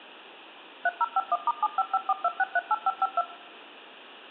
DTMF, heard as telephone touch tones, dialled by machine, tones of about 40 ms. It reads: 3051*75542638552